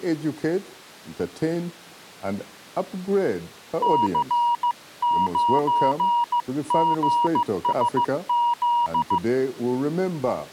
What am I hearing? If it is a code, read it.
Morse code, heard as a keyed tone, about 15 wpm, 950 Hz. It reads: C9GSZ